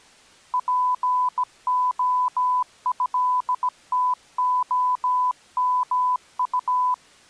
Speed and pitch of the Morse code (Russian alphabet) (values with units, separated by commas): 17 wpm, 1000 Hz